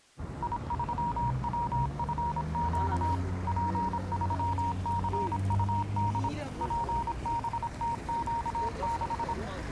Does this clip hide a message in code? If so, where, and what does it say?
Yes: Morse code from 0.4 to 9.4 s, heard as a keyed tone, machine-sent, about 26 wpm, 940 Hz, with street noise. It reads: I3WFQ P3CUD PBTQ6